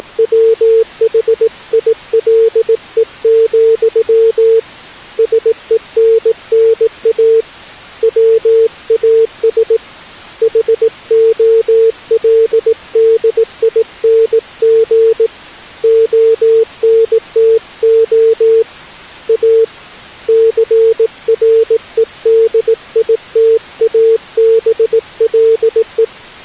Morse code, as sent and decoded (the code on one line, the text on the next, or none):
… / ... . -. -. .- / .-- .- ... / .... --- .-.. -.. .. -. --. / --- -. - --- / .- / -.-. .-. . -.. .. - .- -... .-.. .
… SENNA WAS HOLDING ONTO A CREDITABLE